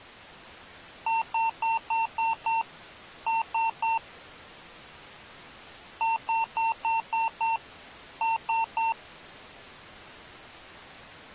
Beep code, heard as beeps from a small speaker, played twice, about 900 Hz. 6-3.